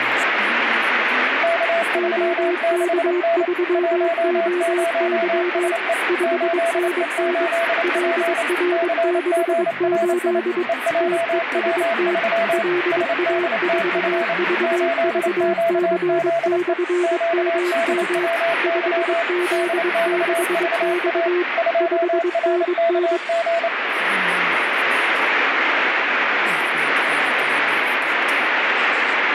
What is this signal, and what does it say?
Morse code, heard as two keyed tones, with radio static. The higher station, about 28 wpm, 670 Hz: K36N 10SE 8E8P CGRI EJW3 SDTF 8QZE QDWY DXVA 2RKG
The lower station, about 22 wpm, 360 Hz: OK3OY 5NN LR68 TEST LA4VVC/MM 5Z6X 5NN